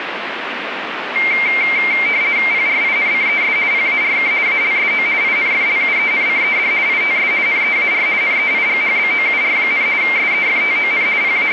RTTY (50 baud, 170 Hz shift), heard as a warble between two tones, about 2200 Hz centre, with radio static. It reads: PRINCES PARK ALSO INFLUENCED ITS NEAR NEIGHBOUR, SEFTON …